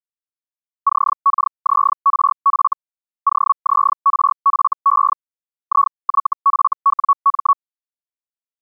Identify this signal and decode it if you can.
Hellschreiber (Feld-Hell, 122.5 baud), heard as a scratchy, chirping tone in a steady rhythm, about 1120 Hz. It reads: CKZRF OZRFE IYFWM